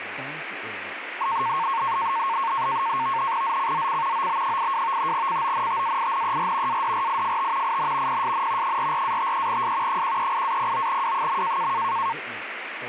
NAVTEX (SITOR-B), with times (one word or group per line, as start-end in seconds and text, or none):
3.4-4.3 ZCZC
4.1-5.1 OB82
5.1-6.8 CONTAINER
6.7-7.8 ADRIFT
7.6-8.2 IN
8.1-8.8 PSN
8.6-10.0 44-53S
9.9-11.7 138-09W.